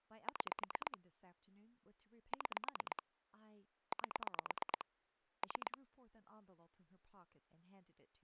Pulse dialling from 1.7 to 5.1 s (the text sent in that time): 6 8